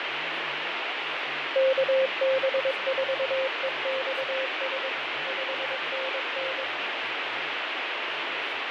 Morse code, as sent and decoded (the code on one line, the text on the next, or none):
-.- -... ....- . -..- ... / ..... -. -.
KB4EXS 5NN